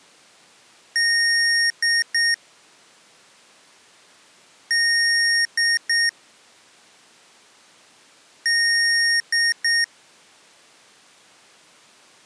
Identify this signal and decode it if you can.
Beep code, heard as beeps from a small speaker, played three times, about 1850 Hz. 1 long, 2 short. In Award, IBM and AMI BIOS tables: video adapter failure.